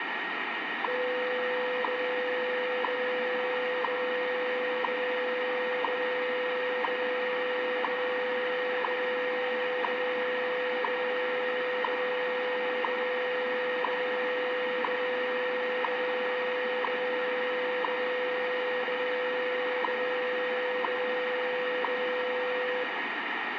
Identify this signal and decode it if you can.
Radio time signal (WWV, Colorado), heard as ticks, one a second, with radio static, a steady whistle near 1870 Hz and room echo.